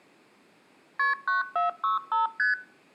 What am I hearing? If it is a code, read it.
Multi-frequency trunk signalling (R1, as on North American trunks), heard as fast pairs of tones, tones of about 140 ms. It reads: KP 9465 ST